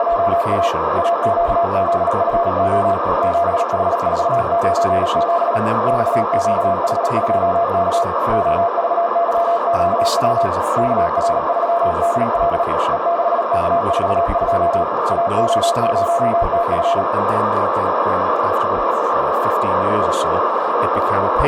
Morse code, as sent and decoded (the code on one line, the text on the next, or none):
… / .- --.- --.. ..-. --- / --... .... ....- ----. --... / -..- --.- .... ..--- -.- / --- ...- -.-- --.- .-- / -.- .-. ...-- -.. .-.. / . -.... -.- ....- ..--- / .- --- ----- - ..-.
… AQZFO 7H497 XQH2K OVYQW KR3DL E6K42 AO0TF